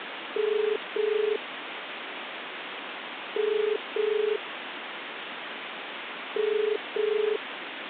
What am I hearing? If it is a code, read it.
Telephone call progress tone (as in the UK, Ireland, Australia and similar networks), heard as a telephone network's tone, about 430 Hz, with phone line noise. Ringback tone.